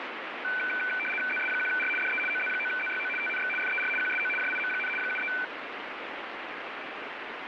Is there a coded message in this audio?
Yes: RTTY (75 baud, 850 Hz shift) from 0.4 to 5.4 s, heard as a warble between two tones, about 1900 Hz centre, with radio static. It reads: ZS1R DE OZ9ZYO TNX FER QSO JIM, 73